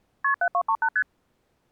Multi-frequency trunk signalling (R1, as on North American trunks), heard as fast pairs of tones, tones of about 70 ms. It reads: KP 7238 ST